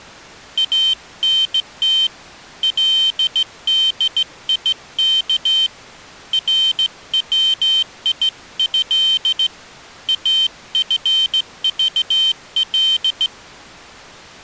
Morse code (Arabic alphabet), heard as a high beeper, hand-sent with a straight key, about 16 wpm, 3100 Hz. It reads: انت لديك رويه افضل